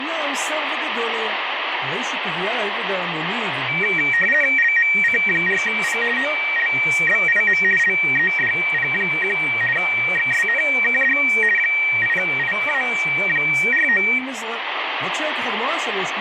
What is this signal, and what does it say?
RTTY (50 baud, 450 Hz shift), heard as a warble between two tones, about 2100 Hz centre, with radio static and speech in Hebrew. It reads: LMC4P OLBIM LEDP1 XSNKD 8IA49